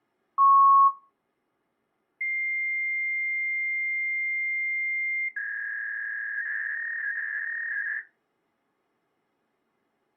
Fax machine handshake, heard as a beep, a long tone and a warble.